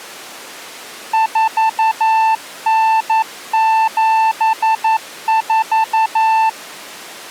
Morse code (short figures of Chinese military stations), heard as a keyed tone, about 11 wpm, 890 Hz. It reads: 4974